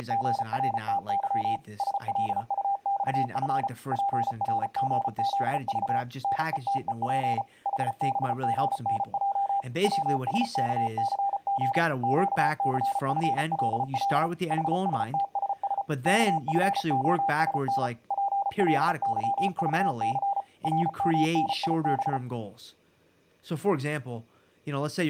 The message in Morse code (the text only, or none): … SLUXF PRGZV NETEP HBGNJ WSKCG QCFLL HSTSS KFOSN PLYVC RMNIB